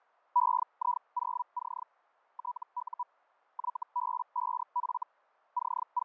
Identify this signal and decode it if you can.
Hellschreiber (Feld-Hell, 122.5 baud), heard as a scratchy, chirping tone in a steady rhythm, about 980 Hz, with fading. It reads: EI0C TU YB5F …